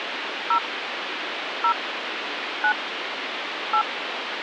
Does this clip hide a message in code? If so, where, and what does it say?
Yes: DTMF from 0.5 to 3.8 s, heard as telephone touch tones, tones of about 80 ms, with phone line noise. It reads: 0 0 9 8